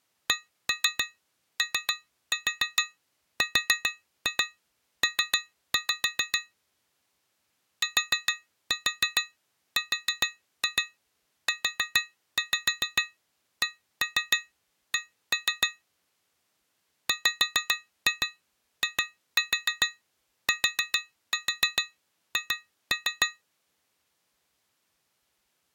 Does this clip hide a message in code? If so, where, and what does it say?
Yes: tap code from 0.3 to 23.4 s, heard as taps on glass, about 7 knocks a second. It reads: CORP TRUCK WITH